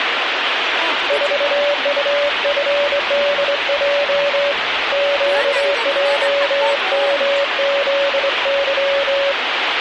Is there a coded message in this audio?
Yes: Morse code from 1.0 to 9.4 s, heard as a keyed tone, hand-sent with a straight key, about 23 wpm, 570 Hz, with radio static and the noise of a park. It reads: 4UFDJ QJMZY